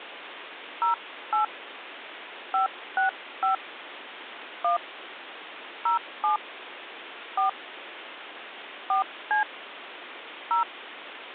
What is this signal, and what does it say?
DTMF, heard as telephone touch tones, dialled by hand, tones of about 120 ms, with phone line noise. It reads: 08 565 1 07 4 4C 0